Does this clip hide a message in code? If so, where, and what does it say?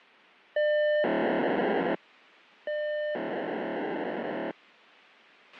Yes: POCSAG pager data (1200 baud) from 0.6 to 4.5 s, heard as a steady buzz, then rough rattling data, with a squelch burst at the end.